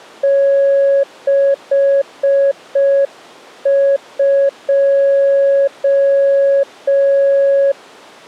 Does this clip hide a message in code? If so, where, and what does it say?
Yes: Morse code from 0.2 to 7.8 s, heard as a keyed tone, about 5 wpm, 550 Hz. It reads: 62